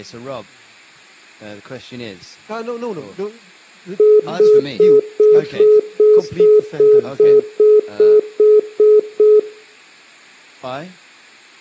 Telephone call progress tone (single-tone plan, as in most of Europe), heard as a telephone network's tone, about 420 Hz, 0.2 s on and 0.2 s off. Congestion tone.